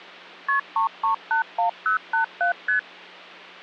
Multi-frequency trunk signalling (R1, as on North American trunks), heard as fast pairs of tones, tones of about 110 ms, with hum. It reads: KP 3381087 ST